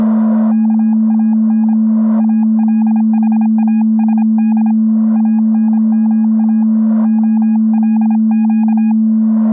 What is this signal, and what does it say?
Morse code (Arabic alphabet), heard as a keyed tone, hand-sent with a paddle, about 26 wpm, 830 Hz. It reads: كان الحاسد انما خلق